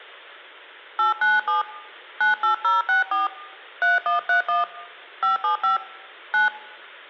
DTMF, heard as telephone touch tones, dialled by hand, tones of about 150 ms. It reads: 897 98064 3131 575 9